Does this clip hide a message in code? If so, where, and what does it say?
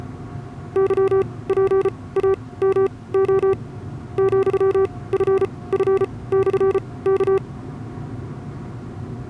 Yes: Morse code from 0.7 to 7.4 s, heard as a keyed tone, machine-sent, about 34 wpm, spaced as for 21 wpm, 390 Hz, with the noise inside a car. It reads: YPAMO ,FF/K